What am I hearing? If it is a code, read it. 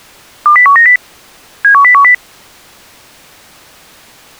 Five-tone selective call (CCIR), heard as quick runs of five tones, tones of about 100 ms. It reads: 20190 71010